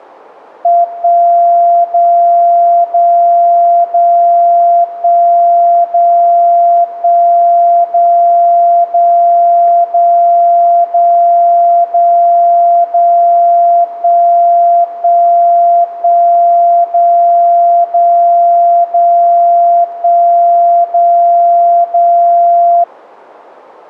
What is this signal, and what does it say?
Radio time signal (DCF77), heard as a tone whose level steps once a second, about 690 Hz. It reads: 1 0 0 0 1 0 1 0 0 0 0 0 0 1 1 1 0 0 0 1 0 0